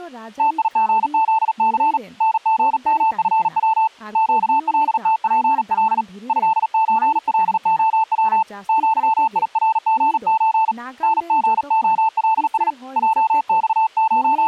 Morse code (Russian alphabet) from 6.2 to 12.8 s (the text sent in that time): ЭЧЛОВ ЪИРГЧ НГОЛС